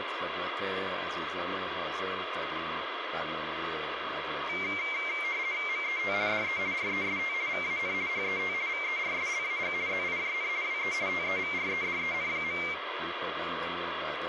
RTTY (50 baud, 170 Hz shift), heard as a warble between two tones, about 2200 Hz centre, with radio static. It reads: MET DE REST VAN HET VERSLAG ZIJN WE TEVREDEN.